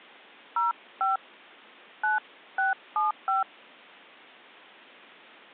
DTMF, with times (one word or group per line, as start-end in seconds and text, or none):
0.6-1.2 05
2.0-3.4 9675